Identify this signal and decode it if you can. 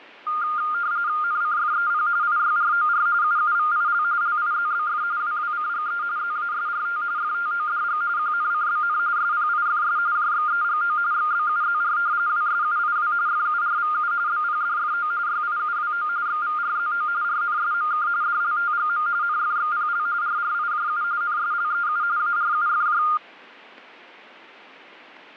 RTTY (45.45 baud, 170 Hz shift), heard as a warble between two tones, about 1310 Hz centre. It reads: NCFEP IYROR UUVIL LIZBF WWCGE ZASRT FTODG QNCBN SPIFS JXEGO XBUZR WSUIW FURVU BPDFO YIUWO XVRZO RNSMK DLTGM NFXPL RRIJU NSLEU ARUFJ